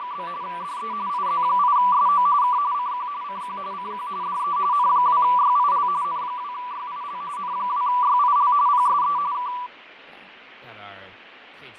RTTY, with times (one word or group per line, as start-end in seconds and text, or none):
0.0-0.3 …
0.4-0.9 DE
1.1-2.3 IZ8SO
2.4-2.6 K
2.7-3.1 CQ
3.2-3.6 CQ
3.7-4.1 CQ
4.2-4.6 DE
4.7-5.9 N2YIL
6.0-7.2 N2YIL
7.4-8.5 N2YIL
8.7-9.2 PSE
9.3-9.5 K